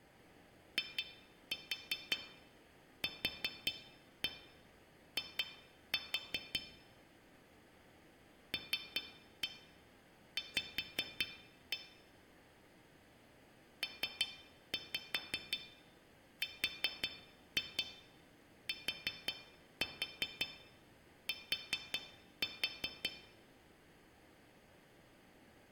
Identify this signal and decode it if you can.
Tap code, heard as taps on glass, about 5 knocks a second, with room echo. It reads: IQI LV PRTT